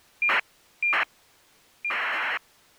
ACARS aircraft data, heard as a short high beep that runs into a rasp, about 2400 baud.